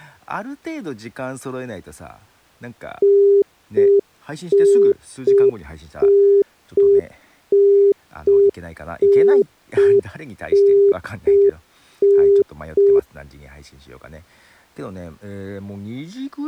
Telephone call progress tone (UK plan), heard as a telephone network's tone, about 400 Hz, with speech in Japanese. Congestion tone.